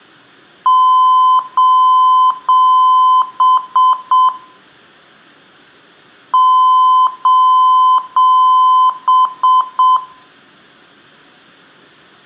Beep code, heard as beeps, played twice, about 1020 Hz, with room echo. 3 long, 3 short.